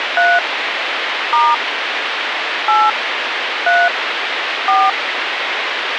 DTMF, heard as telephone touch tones, dialled by hand, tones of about 220 ms, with phone line noise. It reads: 3 * 8 3 4